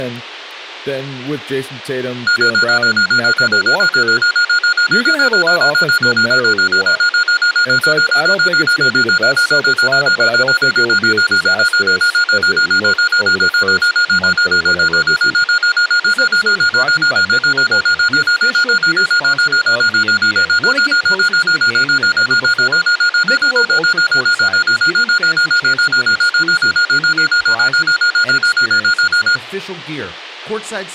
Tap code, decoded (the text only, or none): none